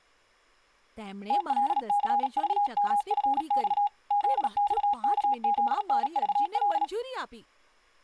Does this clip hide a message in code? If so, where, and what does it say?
Yes: Morse code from 1.2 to 6.9 s, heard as a keyed tone, hand-sent with a paddle, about 37 wpm, 820 Hz, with speech in Gujarati. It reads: TLCVMFX ZXKZNVL